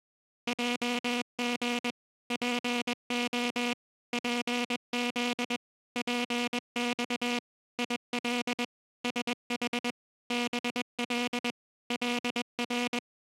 Morse code, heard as a buzzer, machine-sent, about 21 wpm. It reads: JG PO PZ PX IL SH BL LR